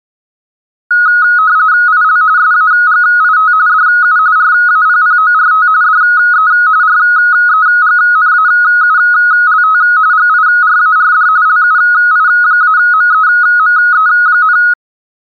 RTTY (45.45 baud, 170 Hz shift), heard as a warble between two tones, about 1360 Hz centre. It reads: IL SAGIT DU RAPPORT DE REGNAULT GIRARD LUI-MEME,